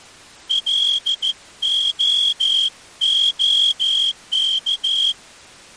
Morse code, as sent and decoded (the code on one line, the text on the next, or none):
.-.. --- --- -.-
LOOK